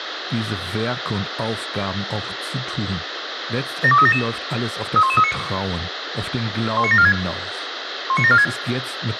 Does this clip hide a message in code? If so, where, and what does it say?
Yes: five-tone selective call (ZVEI) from 3.8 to 8.4 s, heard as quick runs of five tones, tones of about 70 ms, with radio hiss and a squelch burst at the end. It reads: 72377 31139 19746 19746